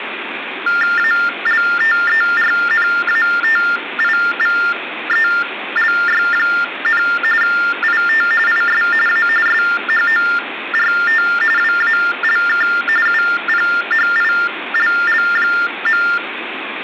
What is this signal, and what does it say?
TTY/TDD text telephone tones (45.45 baud Baudot), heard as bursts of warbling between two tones, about 400 Hz shift, 1600 Hz centre, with phone line noise. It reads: ALTERNATIVELY, IT IS A SHORT WALK UPHILL.